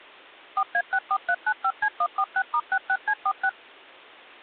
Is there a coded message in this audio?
Yes: DTMF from 0.6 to 3.5 s, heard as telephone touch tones, dialled by machine, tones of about 60 ms. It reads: 4A64395C146*66C46